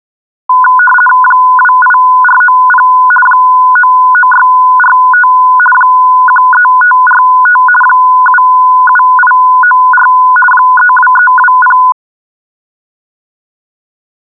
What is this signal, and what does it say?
RTTY (50 baud, 450 Hz shift), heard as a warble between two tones, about 1240 Hz centre. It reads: 28490 99645 13545 77894 32320